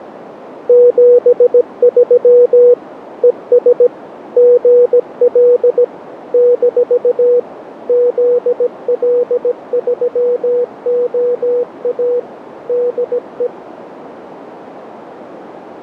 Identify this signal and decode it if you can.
Morse code, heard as a keyed tone, machine-sent, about 17 wpm, 490 Hz, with radio static, fading and a narrow filter. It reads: 73 ES GL - ZL3OA DE